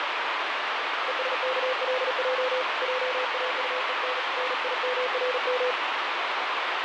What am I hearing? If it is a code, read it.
Morse code, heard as a keyed tone, hand-sent with a paddle, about 38 wpm, 510 Hz, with heavy radio static. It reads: ESKLJ JAUEN NIMRM